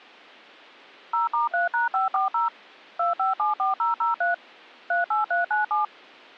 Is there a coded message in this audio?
Yes: DTMF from 1.1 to 5.8 s, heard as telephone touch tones, dialled by machine, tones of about 140 ms. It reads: 0*3#540 2574003 38397